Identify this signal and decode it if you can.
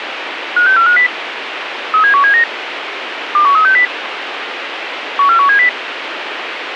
Five-tone selective call (CCIR), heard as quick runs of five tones, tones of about 100 ms, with radio hiss. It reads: 56450 37179 21360 14170